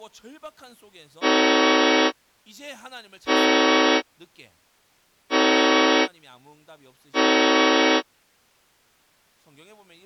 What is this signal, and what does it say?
Train horn signal, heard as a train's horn, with speech in Korean. 4 short. On North American railways: a request for a signal to be given or repeated.